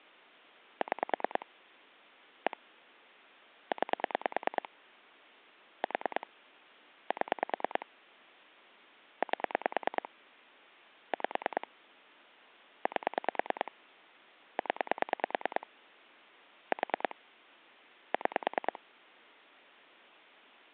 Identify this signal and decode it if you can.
Pulse dialling, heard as clicks on a phone line, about 9 pulses a second. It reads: 6 1 9 4 7 8 5 8 0 4 6